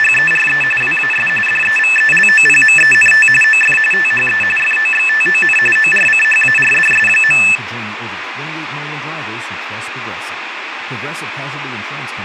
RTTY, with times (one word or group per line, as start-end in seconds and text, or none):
0.0-0.6 …
0.8-1.3 WAS
1.5-3.3 DEVELOPMENT
3.4-3.8 OF
3.9-4.4 THE
4.6-5.6 FOXTON
5.8-7.4 ORCHARDS.